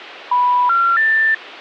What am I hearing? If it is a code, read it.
Telephone call progress tone (North American plan), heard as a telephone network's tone, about 980, 1370, 1800 Hz. Special information tone.